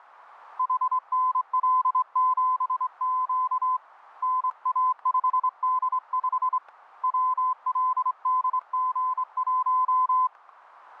Morse code, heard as a keyed tone, hand-sent with a straight key, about 25 wpm, 1020 Hz, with static crashes. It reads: HNL7Q NA5D5 WLDG1